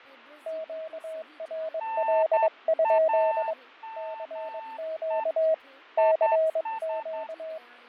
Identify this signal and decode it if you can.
Morse code, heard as two keyed tones, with fading and speech in Sindhi. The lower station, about 22 wpm, 640 Hz: QRL? CQ CQ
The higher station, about 10 wpm, 890 Hz: NAME IS